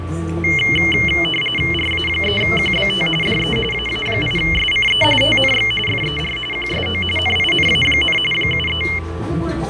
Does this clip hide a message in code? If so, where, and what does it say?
Yes: RTTY (45.45 baud, 850 Hz shift) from 0.4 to 9.0 s, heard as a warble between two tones, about 2550 Hz centre, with fading, a steady whistle near 1160 Hz and the noise of a cafe. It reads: RA3QBT DE AA8SCE TNX FER QSO NINA, 73